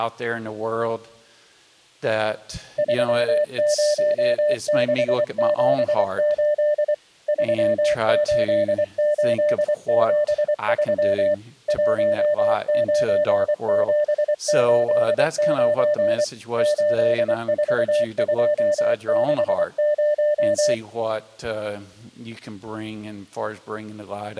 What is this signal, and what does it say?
Morse code, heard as a keyed tone, machine-sent, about 24 wpm, 600 Hz. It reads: 30678 38873 19789 84260